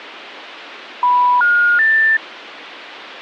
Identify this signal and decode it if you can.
Telephone call progress tone (North American plan), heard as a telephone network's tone, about 980, 1430, 1800 Hz. Special information tone.